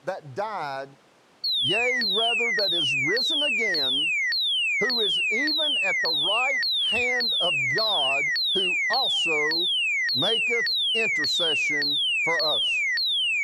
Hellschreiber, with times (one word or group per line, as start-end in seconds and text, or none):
none